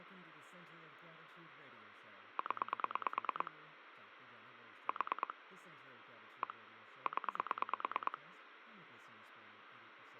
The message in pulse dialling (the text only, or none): 0 4 1 0